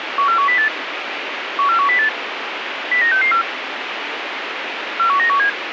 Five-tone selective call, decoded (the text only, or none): 14108 14108 09664 41917